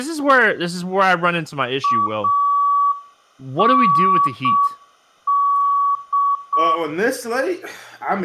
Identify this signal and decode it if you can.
Morse code, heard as a keyed tone, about 6 wpm, 1140 Hz, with room echo and speech in English. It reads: AND